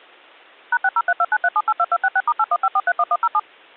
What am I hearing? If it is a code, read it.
DTMF, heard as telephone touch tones, dialled by machine, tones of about 50 ms. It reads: #603293782266*815431107